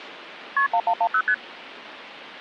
Multi-frequency trunk signalling (R1, as on North American trunks), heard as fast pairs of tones, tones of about 70 ms. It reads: KP 1110 ST